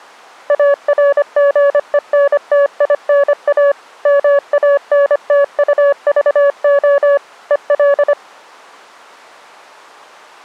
Morse code, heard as a keyed tone, machine-sent, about 25 wpm, 560 Hz. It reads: ARGENTINA MANTUVO EL